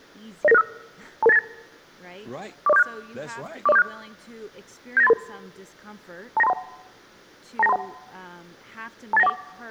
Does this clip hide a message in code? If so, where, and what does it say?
Yes: five-tone selective call (EIA) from 0.4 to 9.3 s, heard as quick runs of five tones, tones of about 30 ms, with speech in English. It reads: 09965 22898 40476 40476 79833 29231 29231 28914